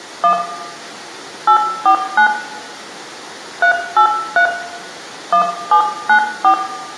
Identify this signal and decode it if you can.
DTMF, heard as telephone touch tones, dialled by hand, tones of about 90 ms, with room echo. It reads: 1 849 383 1794